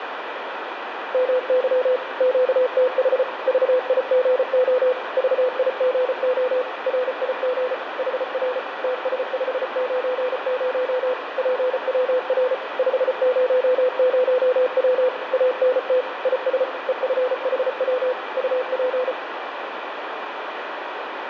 Morse code, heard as a keyed tone, machine-sent, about 34 wpm, 510 Hz, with radio static and room echo. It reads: MY QTH VIGO VIGO RIG HR TS590 PWR 500W ANT IS EFHW UP